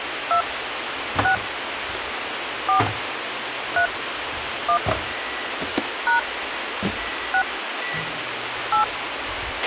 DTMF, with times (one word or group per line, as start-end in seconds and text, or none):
0.3-0.4 2
1.2-1.3 6
2.7-2.8 4
3.8-3.9 3
4.7-4.8 1
6.1-6.2 #
7.3-7.4 6
8.7-8.8 8